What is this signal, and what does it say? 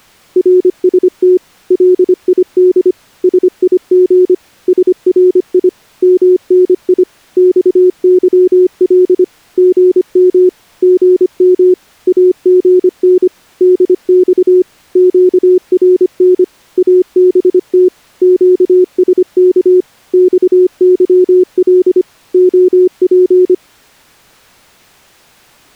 Morse code, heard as a keyed tone, machine-sent, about 25 wpm, 360 Hz. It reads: RST LID SIG SRI MNI XYL GM GM AGN DX QRN ABT QSK XYL OP